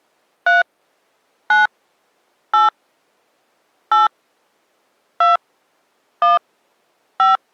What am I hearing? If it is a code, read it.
DTMF, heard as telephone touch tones, dialled by hand, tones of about 150 ms. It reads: 3 9 8 8 2 1 5